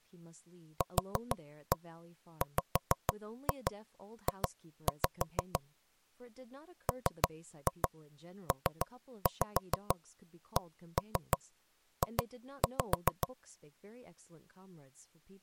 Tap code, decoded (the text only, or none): QWJ MPCJ